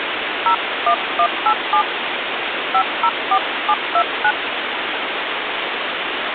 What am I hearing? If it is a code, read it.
DTMF, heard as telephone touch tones, dialled by hand, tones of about 70 ms, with phone line noise. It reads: 01187 504729